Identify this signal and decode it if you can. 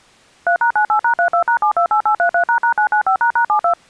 DTMF, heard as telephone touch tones, dialled by machine, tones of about 90 ms. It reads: 3#98#32#728833##995##72